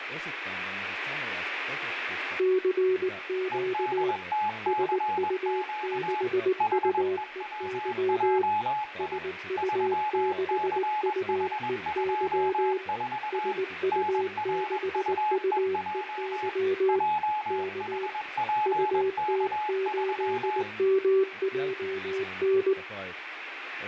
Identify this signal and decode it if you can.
Morse code, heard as two keyed tones, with radio static and speech in Finnish. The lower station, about 19 wpm, 380 Hz: CQ SU6UEY SU6UEY SU6UEY K UT8MJN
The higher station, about 21 wpm, 850 Hz: EDTCQ HEWJI 3CH24 NRUEJ JHPK3